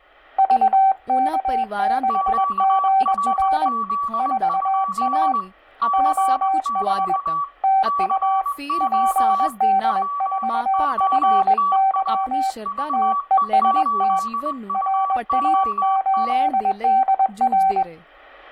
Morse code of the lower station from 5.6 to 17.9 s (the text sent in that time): OH TU PD4FY TEST RA8DR